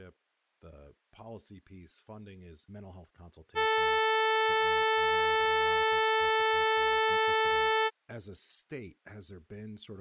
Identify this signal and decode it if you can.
Ship horn signal, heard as a ship's horn, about 440 Hz, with speech in English. 1 long. At sea: a vessel nearing a blind bend, or under power and making way in fog.